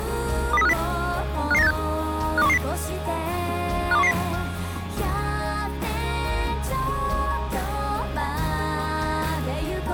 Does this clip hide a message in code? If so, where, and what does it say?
Yes: five-tone selective call (EEA) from 0.5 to 4.1 s, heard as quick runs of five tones, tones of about 40 ms. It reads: 20350 55986 52110 52110